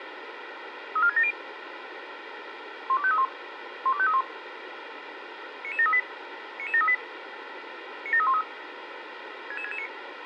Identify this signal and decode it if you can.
Five-tone selective call (ZVEI), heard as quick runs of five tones, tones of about 70 ms, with radio hiss. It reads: 34670 12531 12531 99738 99738 97313 66669